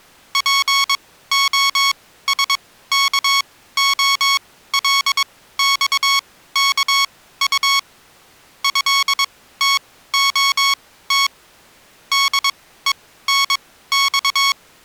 Morse code (Russian alphabet), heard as electronic beeps, machine-sent, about 22 wpm, spaced as for 15 wpm, 1110 Hz. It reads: ПОСКОЛЬКУ ЭТОТ ДЕНЬ